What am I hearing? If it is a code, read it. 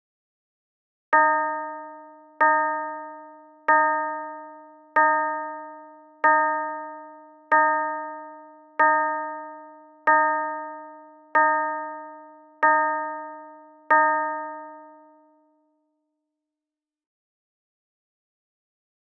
Clock strike, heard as a bell. 11. Eleven o'clock.